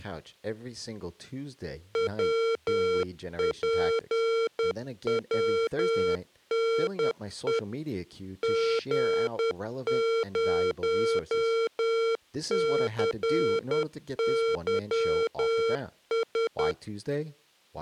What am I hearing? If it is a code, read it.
Morse code, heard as electronic beeps, machine-sent, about 10 wpm, 460 Hz, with speech in English. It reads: WPWNE G0CYS